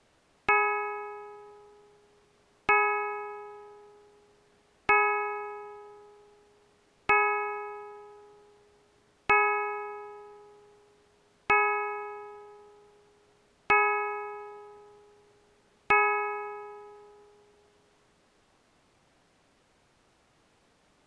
Clock strike, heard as a bell. 8. Eight o'clock.